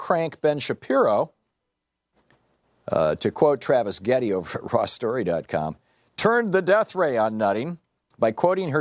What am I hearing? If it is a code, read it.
Speech in English. There is no code.